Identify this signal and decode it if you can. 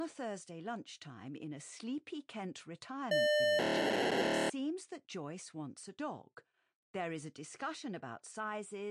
POCSAG pager data (1200 baud), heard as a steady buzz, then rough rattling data, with speech in English.